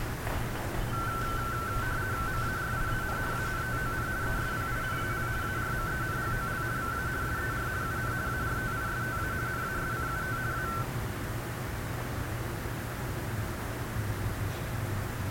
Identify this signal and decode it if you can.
RTTY (50 baud, 170 Hz shift), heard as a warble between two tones, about 1440 Hz centre, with radio static and a narrow filter. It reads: MARIAN ANTON ESPINAL ARMENGOL VA SER UN ARTISTA NASCUT A